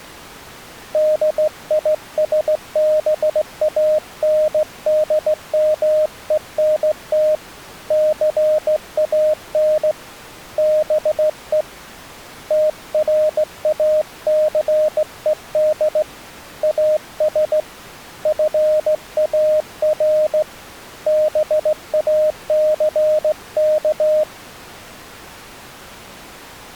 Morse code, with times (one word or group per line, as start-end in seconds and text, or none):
0.9-7.3 DISBANDMENT
7.9-9.9 CAN
10.6-11.6 BE
12.5-16.0 TRACED
16.6-17.6 AS
18.3-20.4 FAR
21.1-24.2 BACK